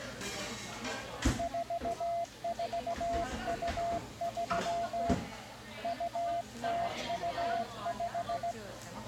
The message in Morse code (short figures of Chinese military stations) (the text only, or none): 4423 2025